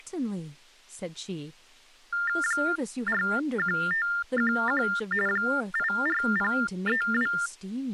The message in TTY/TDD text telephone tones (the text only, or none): 41511 84032